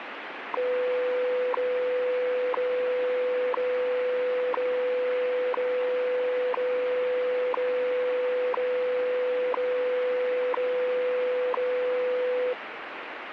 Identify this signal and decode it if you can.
Radio time signal (WWV, Colorado), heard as ticks, one a second, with radio static.